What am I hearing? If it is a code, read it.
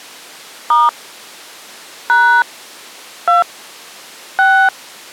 DTMF, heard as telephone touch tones, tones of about 230 ms. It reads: * # 2 6